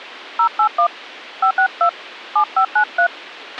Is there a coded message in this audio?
Yes: DTMF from 0.4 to 3.1 s, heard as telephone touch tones, dialled by hand, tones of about 90 ms, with a squelch burst at the end. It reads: 081 562 7593